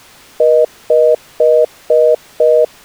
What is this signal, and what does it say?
Telephone call progress tone (North American plan), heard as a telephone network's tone, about 480, 620 Hz, 0.25 s on and 0.25 s off. Congestion tone.